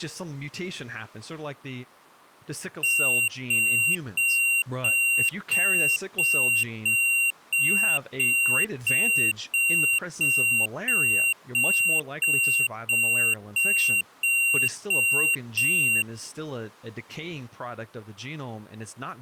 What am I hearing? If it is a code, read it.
Evenly repeated beeps, with speech in English. There is no code.